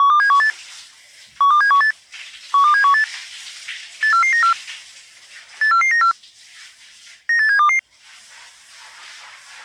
Five-tone selective call (CCIR), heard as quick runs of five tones, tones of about 100 ms, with the noise of a restroom. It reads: 12718 12718 12718 84494 84494 98722